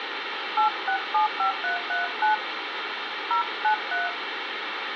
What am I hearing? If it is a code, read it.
DTMF, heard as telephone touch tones, dialled by hand, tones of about 120 ms, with phone line noise. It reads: 8675339 093